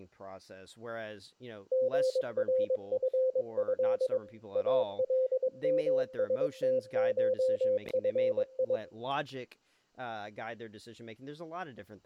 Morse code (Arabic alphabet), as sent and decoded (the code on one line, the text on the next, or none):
--. .-. ..-. ..-.. / .- .-.. -- ... - ---- ..-. ..
غرفه المستشفي